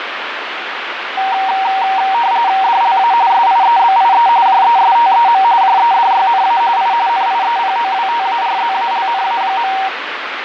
RTTY (45.45 baud, 170 Hz shift), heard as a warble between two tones, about 850 Hz centre, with radio static. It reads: DLA SIEBIE JESTEM JEDYNA I NIEPOWTARZALNA.